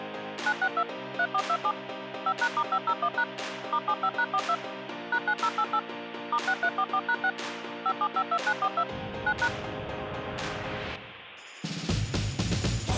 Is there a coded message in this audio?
Yes: DTMF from 0.5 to 9.5 s, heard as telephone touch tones, dialled by machine, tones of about 60 ms. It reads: 962 3427 5#*501# *75#42 #9088 *6344#6 5752942 9#